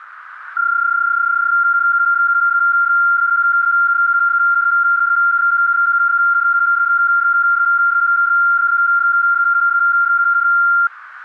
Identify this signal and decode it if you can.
PSK31 (31.25 baud), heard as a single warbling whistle, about 1390 Hz, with radio static.